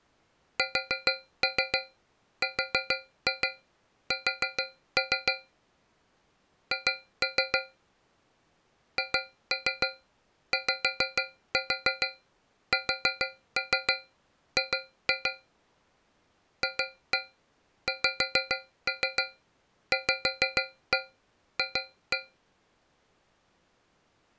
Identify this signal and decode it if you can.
Tap code, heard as taps on a metal pipe, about 6 knocks a second. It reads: SRS H HYSG FXVF